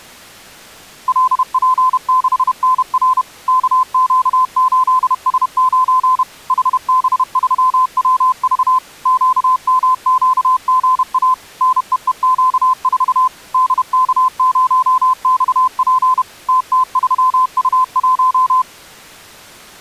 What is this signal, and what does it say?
Morse code, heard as a keyed tone, machine-sent, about 31 wpm, 1020 Hz. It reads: LP6NR KQ8S9 HB3WV QMQGA NEEQ4 DK0XP TT3U1